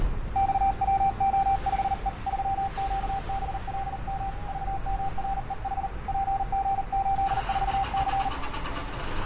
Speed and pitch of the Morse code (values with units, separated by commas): 39 wpm, 780 Hz